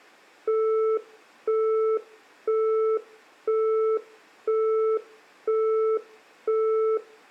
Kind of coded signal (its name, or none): telephone call progress tone